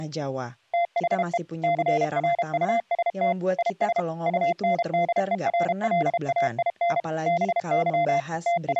Morse code, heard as a keyed tone, machine-sent, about 32 wpm, 690 Hz, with speech in Indonesian. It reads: THE CRUST IS UNDERLAIN BY …